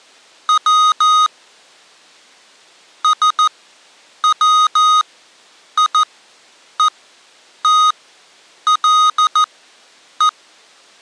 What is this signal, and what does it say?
Morse code, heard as electronic beeps, machine-sent, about 14 wpm, spaced as for 8 wpm, 1250 Hz. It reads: W SWIETLE